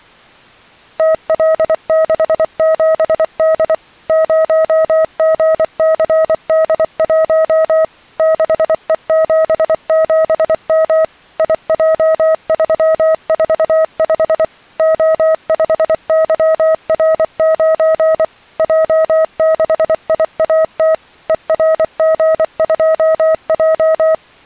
Morse code, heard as a keyed tone, machine-sent, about 24 wpm, 640 Hz. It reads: TL67D 0GCD1 6E77M IJ345 O5YR9 J6IAT ERG2J